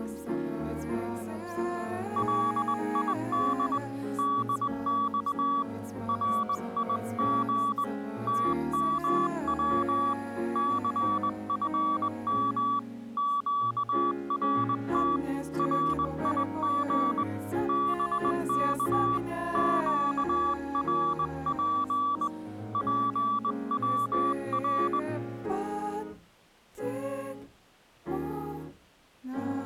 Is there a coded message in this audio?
Yes: Morse code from 2.1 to 25.1 s, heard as a keyed tone, hand-sent with a straight key, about 20 wpm, 1150 Hz. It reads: LID DX RIG TMW CFM QRT RIG BK QRP PWR